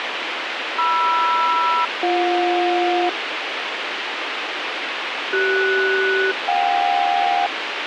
Aircraft SELCAL, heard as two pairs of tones, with radio hiss. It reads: MR-BJ CS-JK